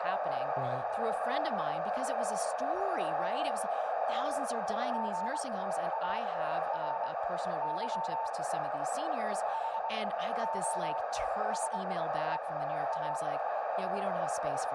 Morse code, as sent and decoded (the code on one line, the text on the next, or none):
--. .- .-. -.-- / .... --- ... . .-
GARY HOSEA